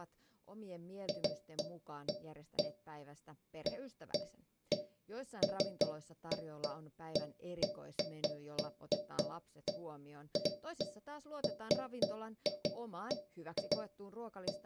Irregular taps on a metal pipe, with speech in Finnish. There is no code.